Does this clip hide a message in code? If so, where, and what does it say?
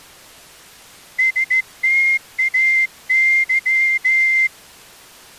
Yes: Morse code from 1.1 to 4.5 s, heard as a whistle, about 14 wpm. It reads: STAY